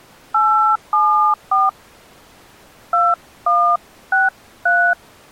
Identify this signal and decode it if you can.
DTMF, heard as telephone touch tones, dialled by hand, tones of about 290 ms. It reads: 874 2163